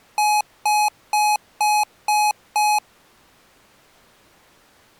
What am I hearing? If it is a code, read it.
Beep code, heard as beeps from a small speaker, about 840 Hz. 6 short. In AMI BIOS tables: keyboard controller gate A20 failure; in Dell tables: video card failure.